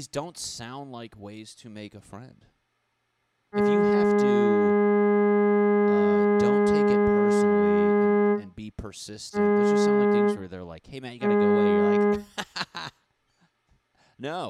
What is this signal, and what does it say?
Ship horn signal, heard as a ship's horn, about 210 Hz, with speech in English. 1 long, 2 short. At sea: a vessel in fog that is sailing, fishing, towing or hampered.